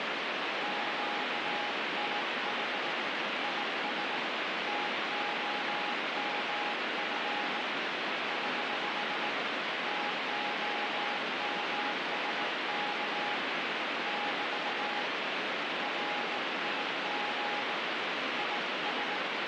Morse code, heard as a keyed tone, hand-sent with a bug key, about 18 wpm, 830 Hz, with heavy radio static. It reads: QTH IS TOMF <HH> TOMSK <BT> RIG IS